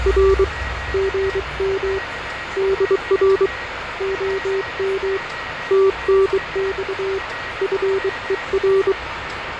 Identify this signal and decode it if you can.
Morse code, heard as a keyed tone, hand-sent with a bug key, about 23 wpm, 390 Hz, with radio static, fading, a weaker station near 1900 Hz and the noise of a restroom. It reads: R GM DR OM TNX FER